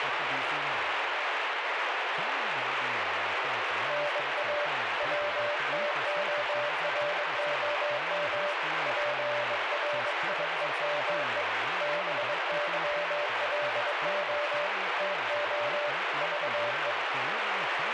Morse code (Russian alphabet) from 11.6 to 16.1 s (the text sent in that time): БЫЛО ТО